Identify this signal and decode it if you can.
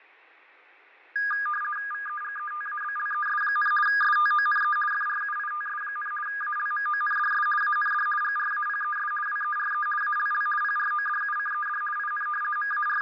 RTTY (50 baud, 450 Hz shift), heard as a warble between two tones, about 1430 Hz centre, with fading and room echo. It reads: VEGETABLES, STONE FRUITS, ALMONDS AND GRAPES WERE ALL PRODUCED IN …